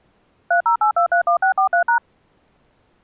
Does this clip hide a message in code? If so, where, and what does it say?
Yes: DTMF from 0.5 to 2.0 s, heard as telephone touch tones, dialled by machine, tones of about 100 ms. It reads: 308231643#